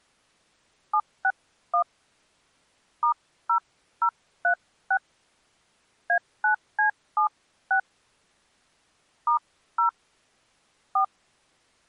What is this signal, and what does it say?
DTMF, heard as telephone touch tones, dialled by hand, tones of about 80 ms. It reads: 761 *0036 A9C76 *0 4